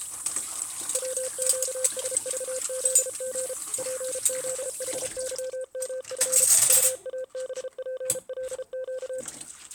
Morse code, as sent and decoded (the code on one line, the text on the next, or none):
.-- --.- ... ...- --.. --. / .--. --.. .... -.-- -- ..-. / ..- .- -... .--. .-.. --.-
WQSVZG PZHYMF UABPLQ